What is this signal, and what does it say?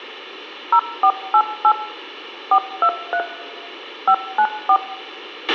DTMF, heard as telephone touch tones, dialled by machine, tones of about 70 ms, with a squelch burst at the end and room echo. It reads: 0488 423 594